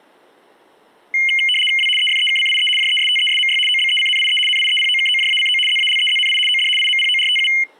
RTTY (75 baud, 850 Hz shift), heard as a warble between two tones, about 2550 Hz centre. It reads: W EFEKCIE JESTESMY OBECNIE NIEPOKOJACO ZALEZNI OD IMPORTU